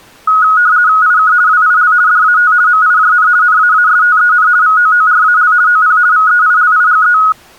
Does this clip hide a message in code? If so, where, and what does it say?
Yes: RTTY (50 baud, 170 Hz shift) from 0.3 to 7.3 s, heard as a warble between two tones, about 1360 Hz centre. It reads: IK WIL DAT MIJN NAASTEN VOORAL OP VEILIGE